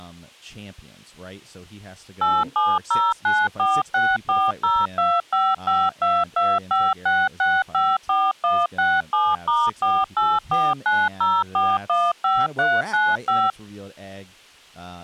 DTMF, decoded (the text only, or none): 870946402552256654167*48490415395